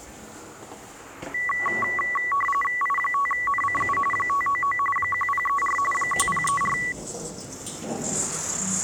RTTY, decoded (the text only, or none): I5NCU 599 1034 1034